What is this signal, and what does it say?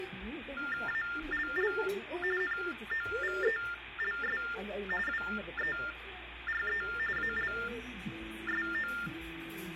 TTY/TDD text telephone tones (45.45 baud Baudot), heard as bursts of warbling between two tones, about 400 Hz shift, 1600 Hz centre, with phone line noise and the noise of a restaurant. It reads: ALL NOVELS WERE ALSO